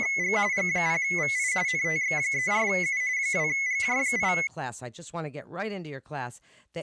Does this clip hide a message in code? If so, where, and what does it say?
Yes: RTTY (45.45 baud, 170 Hz shift) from 0.0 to 4.5 s, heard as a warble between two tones, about 2100 Hz centre, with speech in English. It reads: … G0VI NTX34U 2GJ8